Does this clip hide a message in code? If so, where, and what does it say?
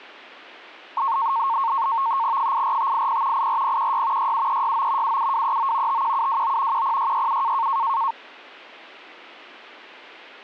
Yes: NAVTEX (SITOR-B), 100 baud, 170 Hz shift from 1.0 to 8.1 s, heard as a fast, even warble, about 1000 Hz centre. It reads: 84580 84016 67369 77239 51729 10667